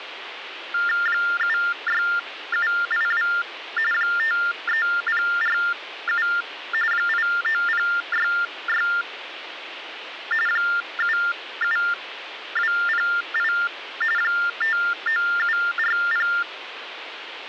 TTY/TDD text telephone tones (45.45 baud Baudot), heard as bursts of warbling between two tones, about 400 Hz shift, 1600 Hz centre, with phone line noise. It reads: 76782 53047 89066 77208 59740